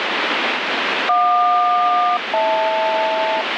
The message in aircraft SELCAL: JQ-HL

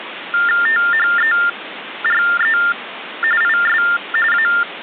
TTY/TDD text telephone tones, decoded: THERE IS A

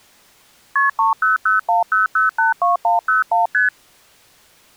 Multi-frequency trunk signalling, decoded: KP 30010082101 ST

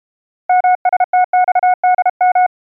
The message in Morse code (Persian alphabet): مستخدم

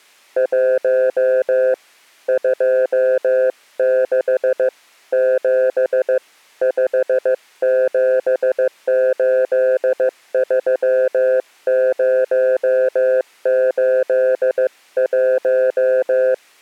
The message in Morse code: 1 26 7 5783081

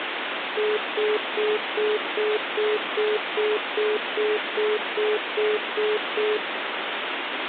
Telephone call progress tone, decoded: congestion tone

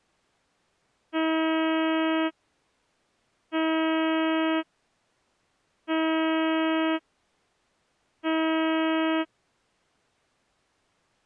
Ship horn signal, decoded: 4 short

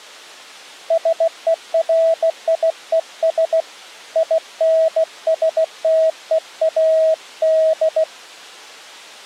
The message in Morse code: SERIES INSTEAD

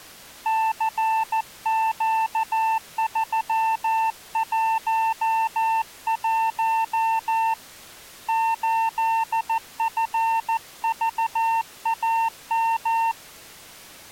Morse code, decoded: CQ311 8FVAM

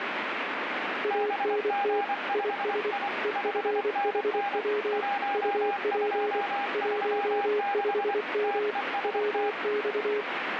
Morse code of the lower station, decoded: ANT IS EFHW UP 15M WX

